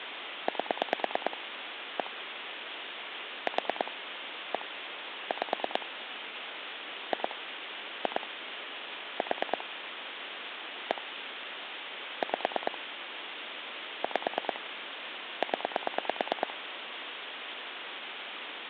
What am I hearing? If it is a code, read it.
Pulse dialling, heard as clicks on a phone line, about 9 pulses a second, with phone line noise. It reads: 8 1 4 1 5 2 2 4 1 5 5 0